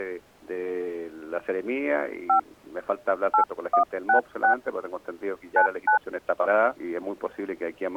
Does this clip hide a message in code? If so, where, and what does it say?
Yes: DTMF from 2.3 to 6.0 s, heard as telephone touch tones, dialled by hand, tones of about 100 ms. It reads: 5 8166 99